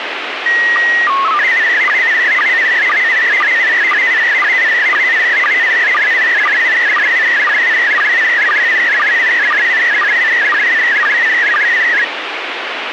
SSTV (slow-scan television), PD 120, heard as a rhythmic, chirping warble, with radio hiss.